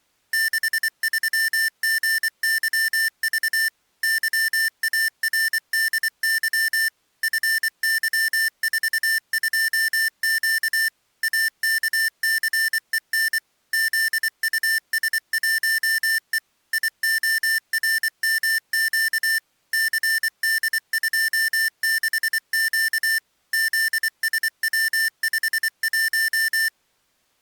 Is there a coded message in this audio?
Yes: Morse code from 0.3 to 26.7 s, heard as electronic beeps, machine-sent, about 24 wpm, 1800 Hz. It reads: 63GYV YARDY FY42Q AKCEN ZUS1E IORMQ CD26Q ZSW51